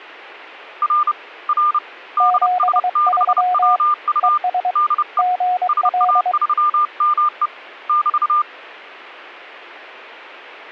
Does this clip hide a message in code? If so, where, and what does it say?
Yes: Morse code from 0.8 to 8.5 s, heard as two keyed tones. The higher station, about 30 wpm, 1200 Hz: R R DS6WU DE SA3ME <BT>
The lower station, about 23 wpm, 730 Hz: 73 ES GL